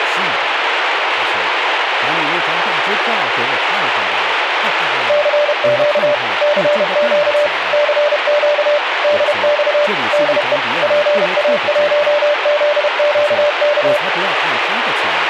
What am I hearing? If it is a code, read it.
Morse code, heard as a keyed tone, machine-sent, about 31 wpm, 590 Hz, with radio static and speech in Chinese. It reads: CQ CQ CQ DX DE PA1ZQK